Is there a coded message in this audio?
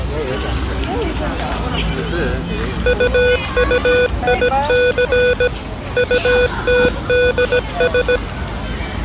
Yes: Morse code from 2.8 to 8.2 s, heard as electronic beeps, machine-sent, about 17 wpm, 490 Hz, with the noise of a park. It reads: UUIC UTDS